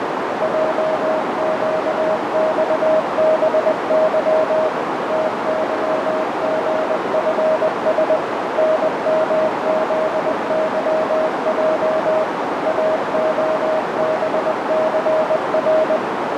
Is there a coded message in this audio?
Yes: Morse code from 0.4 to 16.0 s, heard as a keyed tone, machine-sent, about 20 wpm, 630 Hz, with heavy radio static and a narrow filter. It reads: JQXBY TYGFS NMZYJ AOBCR